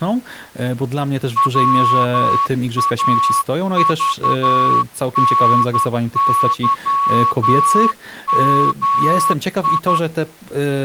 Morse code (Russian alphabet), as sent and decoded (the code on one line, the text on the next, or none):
.-- .- ...- -. -.-- -- ..
ВАЖНЫМИ